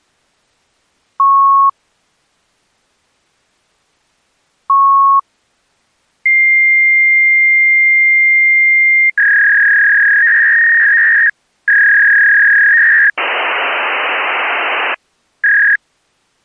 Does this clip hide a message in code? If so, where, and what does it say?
Yes: fax machine handshake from 1.2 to 15.8 s, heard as beeps, a long tone, a warble and hiss.